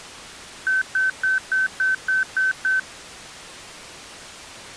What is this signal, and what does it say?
Beep code, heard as beeps, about 1550 Hz. 8 short. In AMI BIOS tables: display memory failure; in Dell tables: LCD failure.